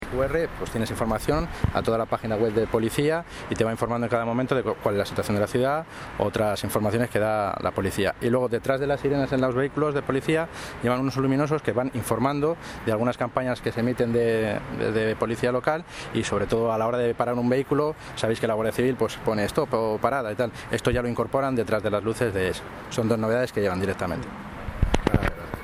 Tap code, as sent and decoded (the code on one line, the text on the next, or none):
none